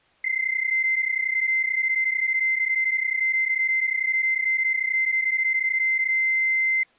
PSK31 (31.25 baud), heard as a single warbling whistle, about 2100 Hz.